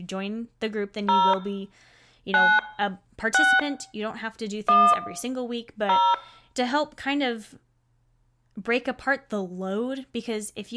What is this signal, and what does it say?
DTMF, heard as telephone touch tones, dialled by hand, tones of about 250 ms, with room echo and speech in English. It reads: 0 9 6 1 0